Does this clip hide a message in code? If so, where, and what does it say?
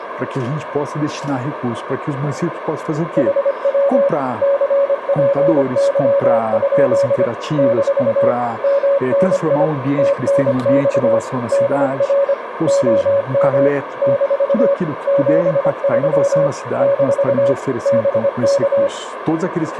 Yes: Morse code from 3.1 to 18.9 s, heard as a keyed tone, machine-sent, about 25 wpm, 560 Hz, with radio static and a narrow filter. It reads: HW CPY? - MNI TNX DR OM - 73 - BK